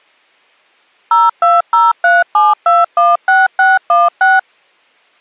DTMF, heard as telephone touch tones, dialled by machine, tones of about 190 ms. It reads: 02037216616